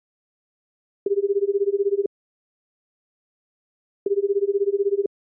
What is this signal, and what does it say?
Telephone call progress tone (Japanese plan), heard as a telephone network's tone, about 380, 400, 420 Hz, 1 s on and 2 s off. Ringback tone.